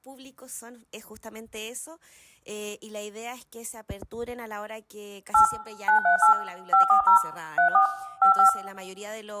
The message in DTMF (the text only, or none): 8 938 540 34 55